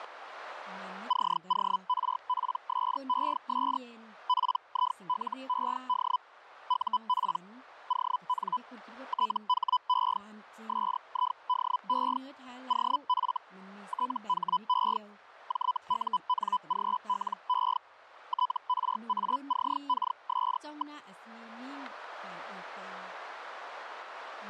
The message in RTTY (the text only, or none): none